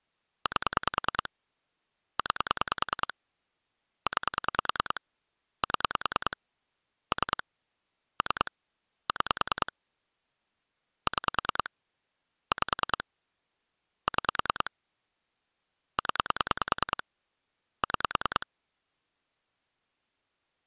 Pulse dialling, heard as clicks on a phone line, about 10 pulses a second. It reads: 8 9 9 7 3 3 6 6 5 6 0 6